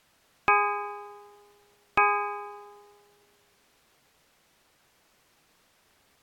Clock strike, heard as a bell. 2. Two o'clock.